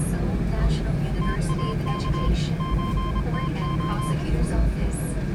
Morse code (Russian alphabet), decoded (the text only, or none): ТАК ЧТО